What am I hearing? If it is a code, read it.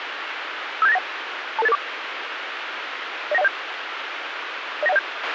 Five-tone selective call (EIA), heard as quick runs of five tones, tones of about 30 ms, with radio hiss and a squelch burst at the end. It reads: 57891 22884 09107 09107